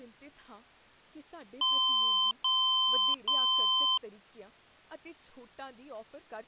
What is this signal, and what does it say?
Beep code, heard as beeps from a small speaker, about 1030 Hz, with speech in Punjabi. 3 long. In IBM BIOS tables: keyboard card error.